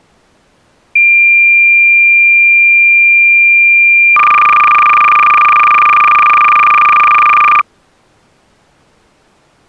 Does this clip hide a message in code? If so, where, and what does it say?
Yes: cassette data (Kansas City type), 300 baud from 1.0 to 7.6 s, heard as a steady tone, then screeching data.